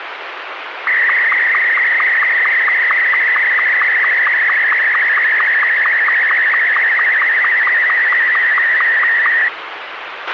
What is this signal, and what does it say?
SSTV (slow-scan television), Martin M2, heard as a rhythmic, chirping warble, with radio hiss and a squelch burst at the end.